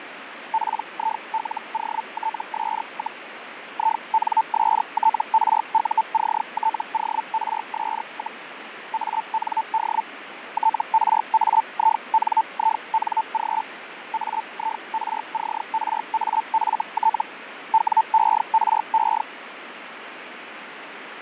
Hellschreiber (Feld-Hell, 122.5 baud), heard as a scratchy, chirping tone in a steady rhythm, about 890 Hz, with radio static and fading. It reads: PILOTS, INSTRUCTORS, AND TRAINING AIRCRAFT WERE